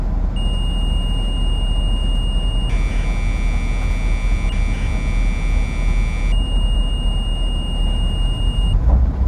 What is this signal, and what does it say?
Commodore tape loading (standard loader), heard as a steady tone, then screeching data, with the noise inside a bus.